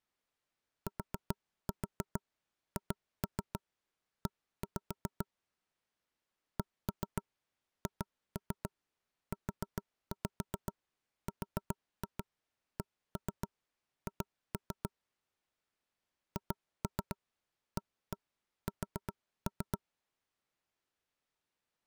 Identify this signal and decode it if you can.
Tap code, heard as knocks on wood, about 7 knocks a second. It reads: THE CHURCH HAS